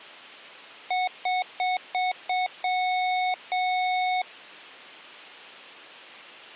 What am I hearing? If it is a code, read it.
Beep code, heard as beeps from a small speaker, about 740 Hz. 5 short, 2 long.